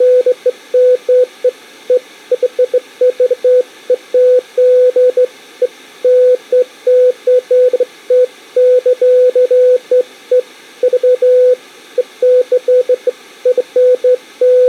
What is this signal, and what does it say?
Beeps of irregular length. There is no code.